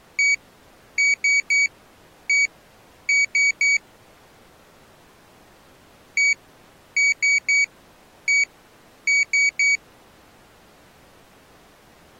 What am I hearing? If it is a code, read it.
Beep code, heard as a piezo beeper, played twice, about 2250 Hz. 1-3-1-3. In Phoenix BIOS tables: keyboard controller test failure.